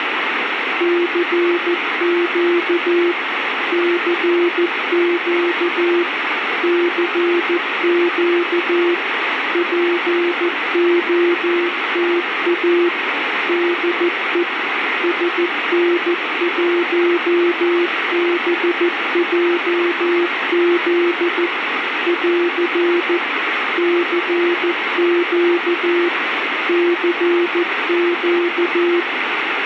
Morse code, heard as a keyed tone, machine-sent, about 14 wpm, 350 Hz, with radio static. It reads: CQ CQ CQ POTA DE SN1BJZ <AR> CQ CQ